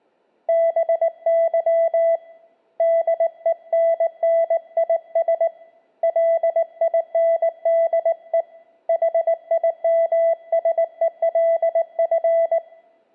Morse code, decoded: BY DENNIS LINDE HIMSELF

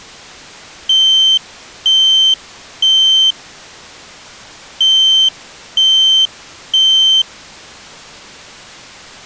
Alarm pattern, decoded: temporal three

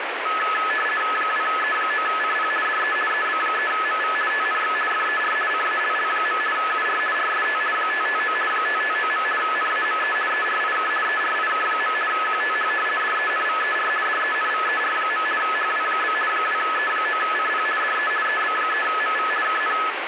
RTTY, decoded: 2E9CP DE EB3MV TNX FER CALL. UR RST 559 559. NAME ERIK ERIK. QTH DENVER DENVER. HW? 2E9CP DE EB3MV KN

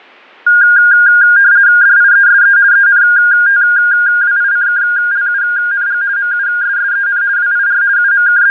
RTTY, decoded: DIESE ENTWICKLUNG MUSSEN WIR …

